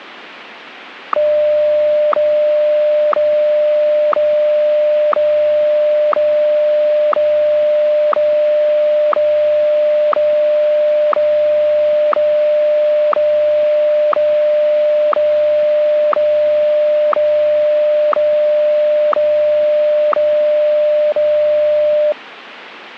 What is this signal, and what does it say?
Radio time signal (WWVH, Hawaii), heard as ticks, one a second.